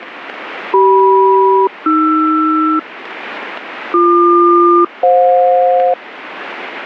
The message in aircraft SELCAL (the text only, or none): CM-AR BQ-FJ